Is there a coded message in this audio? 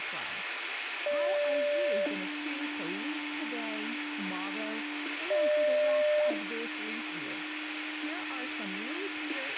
Yes: two-tone page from 1.1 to 9.3 s, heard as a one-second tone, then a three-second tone, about 580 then 300 Hz, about 600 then 300 Hz, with radio hiss, a squelch burst at the end and speech in English.